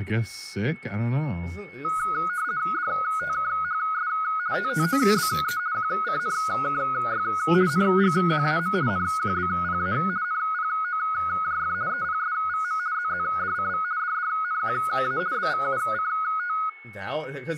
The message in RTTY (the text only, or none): DTKHS TTOBE QCNKY NGQAM NQBPA NPOJF EPSVM ZZDCV DDNQA BVUCT